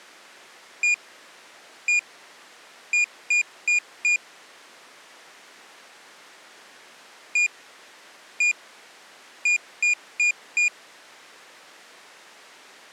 Beep code, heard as a piezo beeper, played twice, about 2450 Hz. 1-1-4. In Phoenix BIOS tables: BIOS ROM checksum failure.